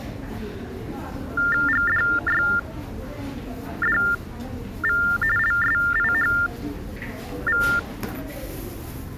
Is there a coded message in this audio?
Yes: TTY/TDD text telephone tones (45.45 baud Baudot) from 1.4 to 7.8 s, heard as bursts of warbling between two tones, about 400 Hz shift, 1600 Hz centre, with the noise of a subway station. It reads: GDYDV LSIHV